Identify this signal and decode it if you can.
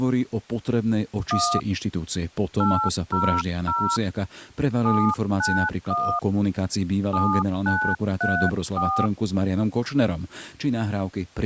DTMF, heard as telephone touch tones, dialled by hand, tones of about 290 ms, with speech in Slovak. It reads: 1 800 791 7934